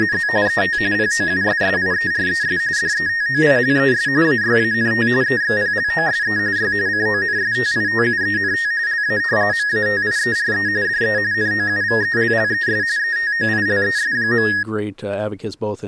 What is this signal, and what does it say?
RTTY (45.45 baud, 170 Hz shift), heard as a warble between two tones, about 1750 Hz centre, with speech in English. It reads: … ET POUSSIERES DETOILES AYANT EXPLOSE Y CONSTITUENT LA MATIERE DE NOUVELLES ETOILES.